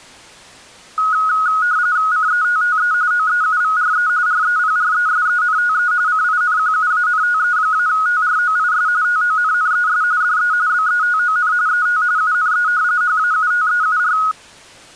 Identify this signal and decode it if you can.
RTTY (45.45 baud, 170 Hz shift), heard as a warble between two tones, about 1360 Hz centre. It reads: CETTE OEUVRE REPRESENTE CINQUANTE-TROIS TONNES DE BETON ET UNE HAUTEUR